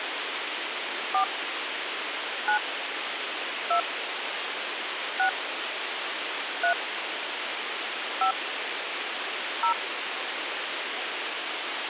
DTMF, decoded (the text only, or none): 4 9 2 6 3 5 0